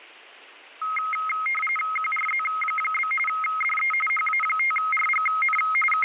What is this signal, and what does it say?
RTTY (45.45 baud, 850 Hz shift), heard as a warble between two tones, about 1700 Hz centre, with radio static. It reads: QRZ? DE HA5RGN …